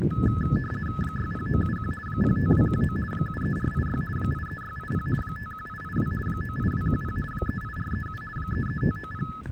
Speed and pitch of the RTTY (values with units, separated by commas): 50 baud, 450 Hz shift, 1500 Hz centre